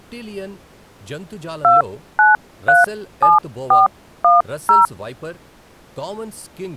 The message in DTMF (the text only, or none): 2937410